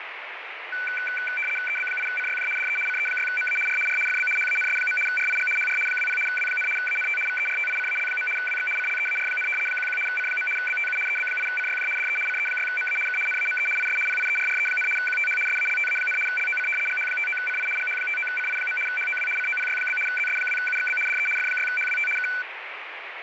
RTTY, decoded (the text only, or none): EB8CYJ DE CE6MA R R FB HANS. RIG HR 20 W, ANT VERTICAL. WX CLEAR, 11 C. BTU EB8CYJ DE CE6MA K NAME IS PIERRE, QTH SALTA, LOC GH59CI GH59CI. HOW COPY? ZS2UXB DE F6HWT K